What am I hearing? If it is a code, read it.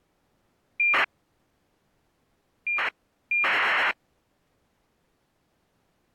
ACARS aircraft data, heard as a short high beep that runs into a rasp, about 2400 baud.